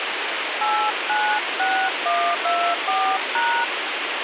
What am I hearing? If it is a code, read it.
DTMF, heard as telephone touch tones, dialled by hand, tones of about 300 ms, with radio hiss. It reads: 896124#